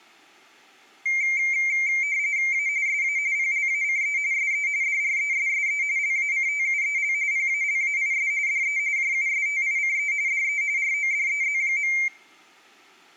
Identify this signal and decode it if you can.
RTTY (45.45 baud, 170 Hz shift), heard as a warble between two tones, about 2200 Hz centre, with room echo. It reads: A SA PLACE SE DRESSE LACTUEL PALAIS DE JUSTICE DE RODEZ.